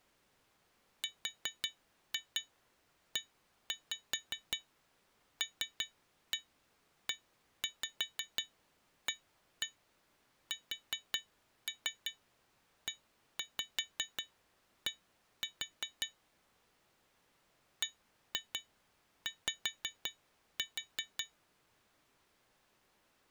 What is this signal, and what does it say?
Tap code, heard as taps on glass, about 5 knocks a second. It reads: RELEASED BY